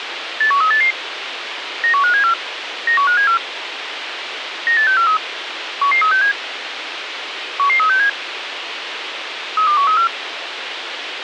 Five-tone selective call (CCIR), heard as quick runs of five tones, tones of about 100 ms, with radio hiss. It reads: 81388 91574 91574 98643 11367 11367 32134